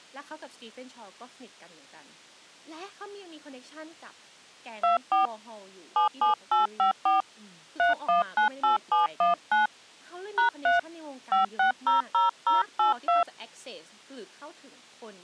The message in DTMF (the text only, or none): 24 77854 3198719 #3 5600082